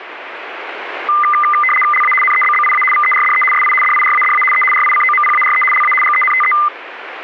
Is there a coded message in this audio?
Yes: RTTY (75 baud, 850 Hz shift) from 1.1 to 6.7 s, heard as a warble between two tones, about 1600 Hz centre, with radio static. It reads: LA NEBBIA VERDE SI DIRADA E RICOMPARE LA GENTE